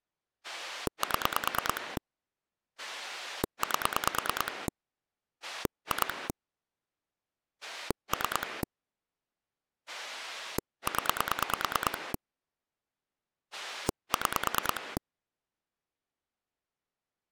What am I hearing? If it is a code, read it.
Pulse dialling, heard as a rotary dial, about 9 pulses a second. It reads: 7 8 2 3 0 6